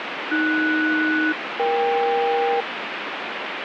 Aircraft SELCAL, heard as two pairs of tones, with radio static. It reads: AS-EK